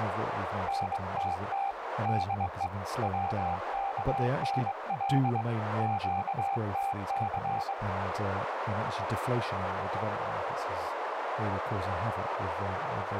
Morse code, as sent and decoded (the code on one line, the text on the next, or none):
-. - - / -.. . / .-- -.- -. .-.. / --.- - -.-.
NTT DE WKNL QTC